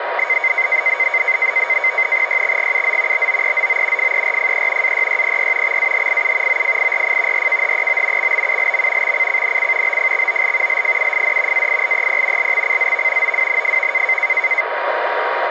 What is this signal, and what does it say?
NAVTEX (SITOR-B), 100 baud, 170 Hz shift, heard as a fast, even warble, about 2150 Hz centre, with radio static and a steady whistle near 950 Hz. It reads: YXGUZ BOEZO FERFE AYYPY XAHIU OFIRF RKHEO XBULM XCCNC BFXOL LFUFD AILEP LXCZV OWNFV